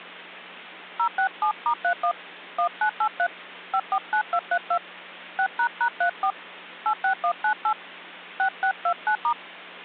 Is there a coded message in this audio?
Yes: DTMF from 1.0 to 9.3 s, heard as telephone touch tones, dialled by hand, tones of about 80 ms, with hum. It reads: 067*31 1983 549232 6##34 86198 6629*